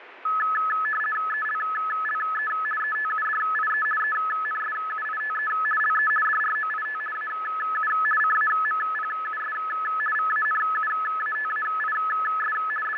RTTY (50 baud, 450 Hz shift), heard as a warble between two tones, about 1500 Hz centre, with radio static and fading. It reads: ELLE ETUDIE ENSUITE LE DROIT AU CAMPUS VANUATAIS …